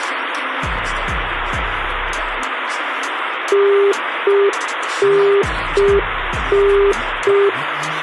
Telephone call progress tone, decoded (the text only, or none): congestion tone